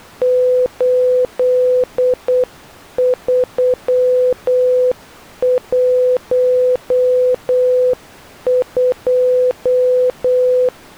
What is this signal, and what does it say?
Morse code, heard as a keyed tone, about 8 wpm, 500 Hz. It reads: 8312